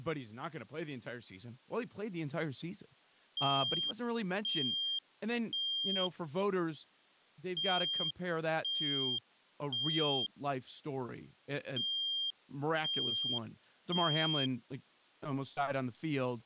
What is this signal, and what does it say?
Alarm pattern, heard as an alarm's beeps, played three times, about 3200 Hz, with speech in English. Temporal three. Smoke or fire, evacuate.